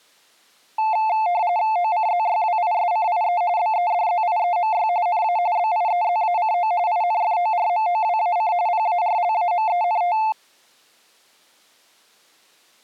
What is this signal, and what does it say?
RTTY (45.45 baud, 170 Hz shift), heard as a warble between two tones, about 790 Hz centre. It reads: OCZYWISCIE BEDZIEMY NA BIEZACO INFORMOWAC PARLAMENT